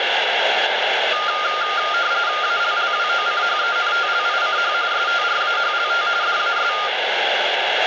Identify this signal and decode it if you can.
RTTY (45.45 baud, 170 Hz shift), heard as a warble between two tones, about 1310 Hz centre, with radio static and room echo. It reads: ALLWOCHENTLICH STRAHLT DAS